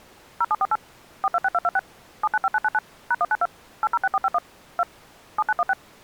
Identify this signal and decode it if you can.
DTMF, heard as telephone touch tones, dialled by machine, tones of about 40 ms. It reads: 0748 426226 795999 #192 806451 2 7916